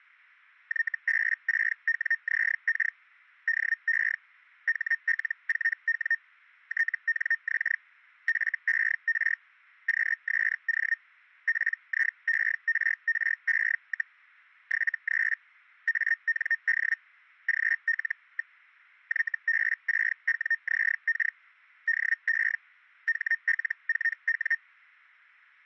Hellschreiber (Feld-Hell, 122.5 baud), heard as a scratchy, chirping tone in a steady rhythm, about 1850 Hz. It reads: YB6WZK DE HL4W TNX FER QSO PIERRE, 73 AND GL. YB6WZK DE HL4W